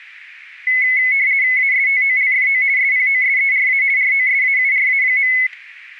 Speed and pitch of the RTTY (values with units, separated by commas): 50 baud, 170 Hz shift, 2100 Hz centre